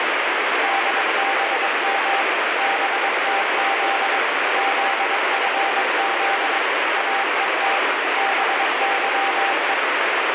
Morse code, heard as a keyed tone, machine-sent, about 22 wpm, 790 Hz, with heavy radio static. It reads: DBM BTZ ZFZ AET BYE